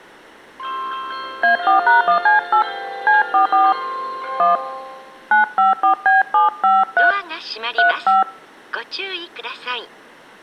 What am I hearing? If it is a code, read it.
DTMF, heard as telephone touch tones, dialled by hand, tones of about 140 ms. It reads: A4#1C8 C44 1 954B753 35